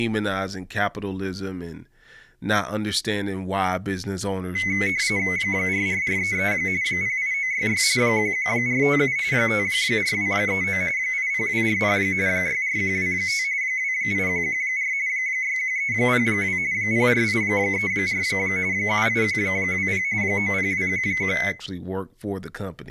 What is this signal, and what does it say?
RTTY (45.45 baud, 170 Hz shift), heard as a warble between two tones, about 2100 Hz centre, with speech in English. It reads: 44433 08966 11457 54239 80240 64125 28114 61302 04834 78120 90211